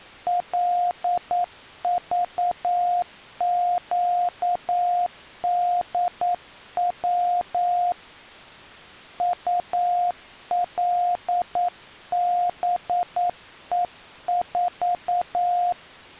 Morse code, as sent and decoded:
.-.. ...- --.- -.. .-- / ..- .-.. -... . ....-
LVQDW ULBE4

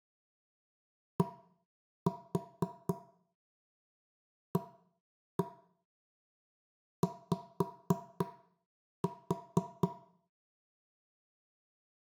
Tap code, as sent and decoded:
1-4 1-1 5-4
DAY

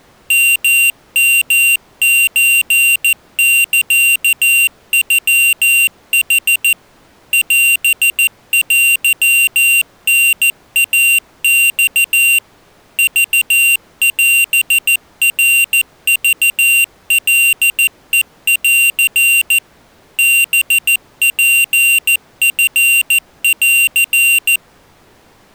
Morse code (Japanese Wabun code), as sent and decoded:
-- -- ---. -.-.- ..-- .... / .-... .-.-- -. .- -..- / ...- .-... .-. ...- .-.. . .-.-. / -... .--. ..-. .-.-.
ヨヨソサノヌ オテタイマ クオナクカヘン ハツチン

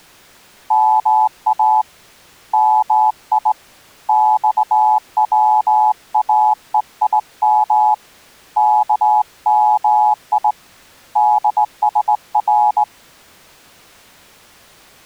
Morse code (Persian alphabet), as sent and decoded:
-- .- / -- .. / -..- .-- .- . .. -- / -.- -- .. / -.. ... .-.
ما می خواهیم کمی دسر

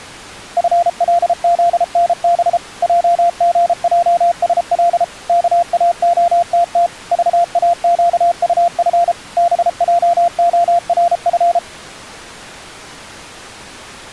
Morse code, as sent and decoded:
..-. .-.. --.. -. -... / .--- --. .--- ... .-.. / -.- .- --- - - / ...- .- --.- ..- ..-. / -... .--- --- .-. ..-.
FLZNB JGJSL KAOTT VAQUF BJORF

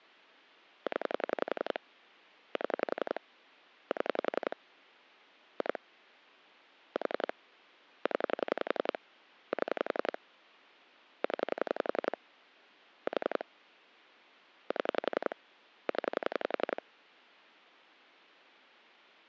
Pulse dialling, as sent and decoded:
10 / 7 / 7 / 2 / 4 / 10 / 7 / 10 / 4 / 7 / 10
0 7 7 2 4 0 7 0 4 7 0

